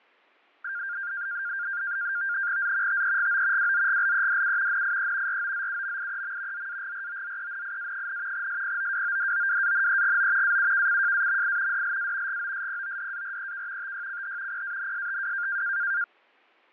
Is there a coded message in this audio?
Yes: NAVTEX (SITOR-B), 100 baud, 170 Hz shift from 0.6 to 16.0 s, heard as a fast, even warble, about 1500 Hz centre, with fading. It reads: Z TEGO WZGLEDU NIE ROZUMIEM ZAGROZENIA, SPOWODOWANEGO AUKCJAMI DLA GOSPODAREK TYCH PANSTW